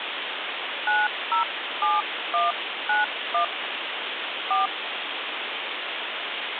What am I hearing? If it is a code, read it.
DTMF, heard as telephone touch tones, dialled by hand, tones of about 150 ms, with phone line noise. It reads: 907191 4